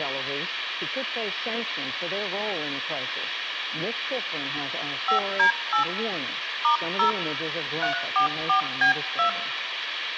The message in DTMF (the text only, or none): 5D8 *0 344B2